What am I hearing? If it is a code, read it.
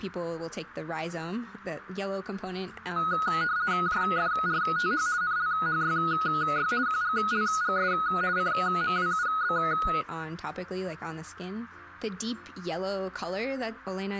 RTTY (50 baud, 170 Hz shift), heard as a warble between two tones, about 1360 Hz centre, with radio static. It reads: JFRTH NLHYY QGLGS CMWUB